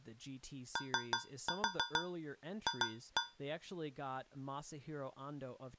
Tap code, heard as taps on a metal pipe, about 6 knocks a second, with speech in English. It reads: OF